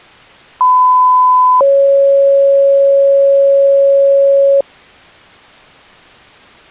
Two-tone page, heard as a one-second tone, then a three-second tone, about 1010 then 550 Hz.